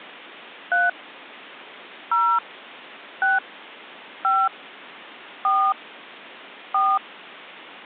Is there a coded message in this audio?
Yes: DTMF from 0.7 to 7.0 s, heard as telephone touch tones, dialled by hand, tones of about 220 ms. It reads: 3 0 6 5 4 4